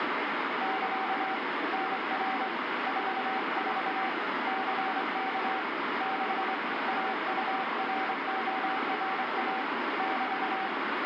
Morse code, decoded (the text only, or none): <KA> NR 44 CK 6 AURORA <BT>